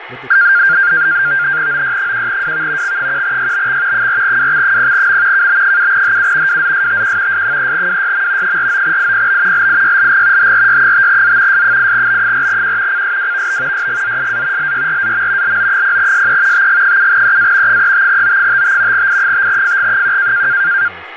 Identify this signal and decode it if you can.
NAVTEX (SITOR-B), 100 baud, 170 Hz shift, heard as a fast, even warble, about 1500 Hz centre, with radio static, fading and speech in English. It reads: OY1WV X1YBX 4WX0M KB7HU WZSTQ S3WYM 49IPB LIYLG HRY5Z S8B4Q CSWVB YGZSA LYRAM LO0SE TG7EA 35O55 I5FG1